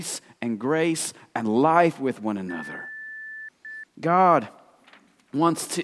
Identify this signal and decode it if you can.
Beep code, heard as beeps, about 1750 Hz, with speech in English. 1 long, 1 short. In IBM BIOS tables: system board problem.